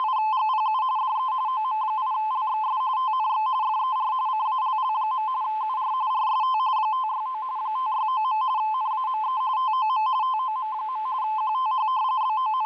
RTTY (45.45 baud, 170 Hz shift), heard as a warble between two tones, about 950 Hz centre. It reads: … DE OM8LXS TNX FER CALL. UR RST 569 569. NAME TOM TOM. QTH …